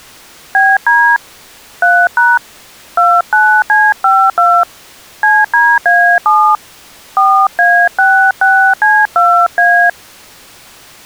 DTMF, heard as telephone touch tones, dialled by hand, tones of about 260 ms. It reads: BD 3# 29C52 CDA7 4A66C2A